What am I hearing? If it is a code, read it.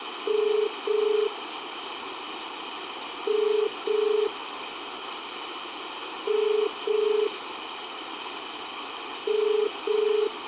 Telephone call progress tone (as in the UK, Ireland, Australia and similar networks), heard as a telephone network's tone, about 430 Hz, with phone line noise. Ringback tone.